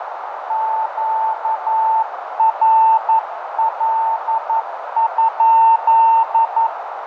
Morse code, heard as a keyed tone, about 11 wpm, 890 Hz, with radio static, fading and a narrow filter. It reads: QRL?